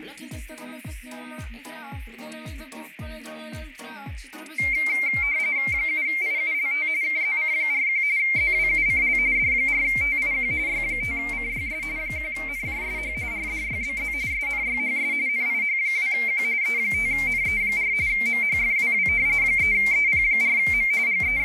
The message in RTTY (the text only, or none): 7IULT KZC41 ZWUCL D4TIQ Y5CYS 1NJSH RDYBZ SNYHS NIH2Q E5NE4 MHFWW 3EP4M …